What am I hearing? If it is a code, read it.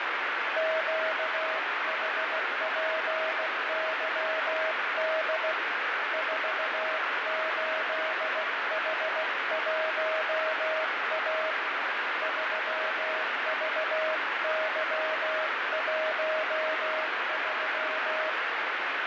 Morse code, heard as a keyed tone, hand-sent with a paddle, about 16 wpm, 630 Hz, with heavy radio static and fading. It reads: QHPYD 48H1A 3VY13